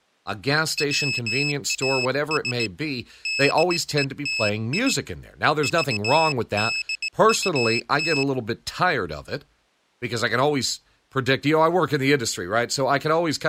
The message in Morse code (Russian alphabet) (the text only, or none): ВАС ДЕТИ ЖДУТ